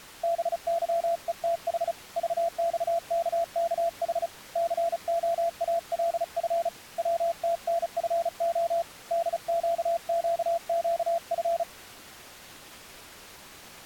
Morse code, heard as a keyed tone, hand-sent with a paddle, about 35 wpm, 680 Hz. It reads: BYETH VXKKH COALF WTNFO DQQQF